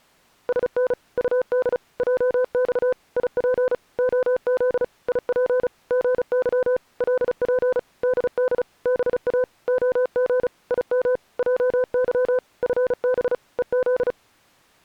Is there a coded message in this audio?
Yes: Morse code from 0.4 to 14.2 s, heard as a keyed tone, machine-sent, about 35 wpm, 510 Hz. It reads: SN UD JX IP OZ IP GY LP DD BA OG IM JY FB EZ